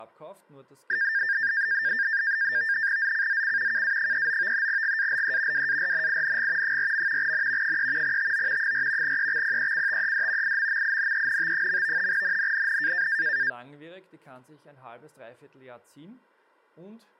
NAVTEX (SITOR-B), 100 baud, 170 Hz shift, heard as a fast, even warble, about 1700 Hz centre, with speech in German. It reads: ZCZC KA39 GALE WARNING 4. N 3 TO 4 EXPECTED IMMINENT. NNNN